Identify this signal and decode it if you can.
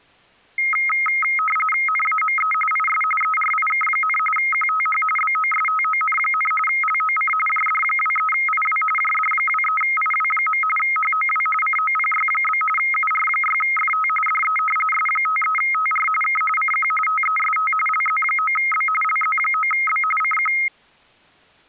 RTTY (45.45 baud, 850 Hz shift), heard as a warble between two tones, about 1700 Hz centre. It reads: NAME IS ERIK, QTH BOSTON, LOC JD23IW JD23IW. HOW COPY? UR6FT DE S53TR K CQ TEST LZ9B LZ9B CQ